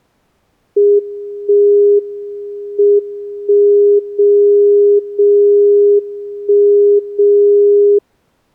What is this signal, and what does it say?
Radio time signal (WWVB), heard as a tone whose level steps once a second, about 410 Hz. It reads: 1 M 1 0 0 1 0